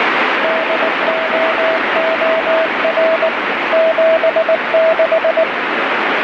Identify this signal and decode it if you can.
Morse code, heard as a keyed tone, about 19 wpm, 650 Hz, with heavy radio static. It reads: DOOR 76